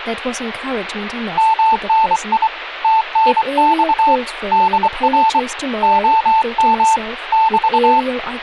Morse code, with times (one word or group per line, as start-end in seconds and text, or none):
1.4-2.5 MNI
2.8-4.2 TNX
4.5-5.4 DR
5.8-7.0 OM
7.3-8.0 <BT>